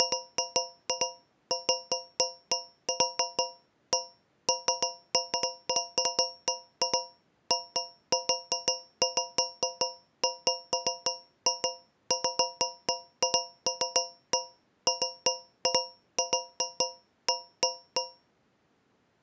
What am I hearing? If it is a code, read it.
Irregular taps on a metal pipe. There is no code.